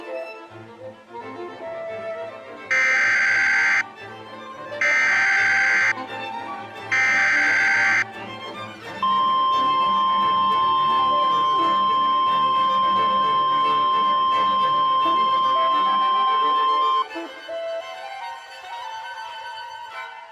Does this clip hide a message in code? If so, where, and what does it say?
Yes: Emergency Alert System (SAME) tones (header bursts, then the 1050 Hz attention tone) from 2.7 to 17.0 s, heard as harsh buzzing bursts, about 520.83 baud.